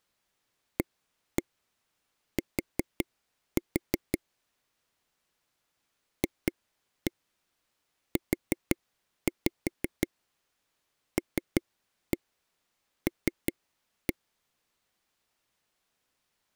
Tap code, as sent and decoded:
1-1 4-4 / 2-1 4-5 3-1 3-1
AT FULL

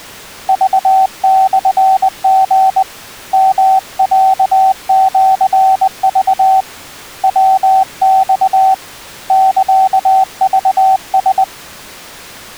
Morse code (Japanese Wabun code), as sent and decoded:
...- -..-. --. / -- .-.- --.-. ...- / .-- -..- / -.-.- ...- ...
クモリ ヨロシク ヤマ サクラ

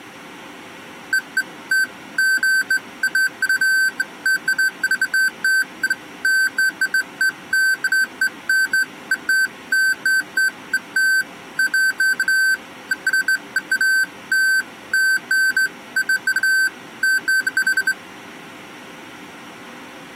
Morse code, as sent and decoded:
none

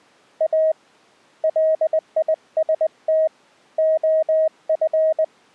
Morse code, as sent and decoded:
.- / .-.. .. ... - / --- ..-.
A LIST OF

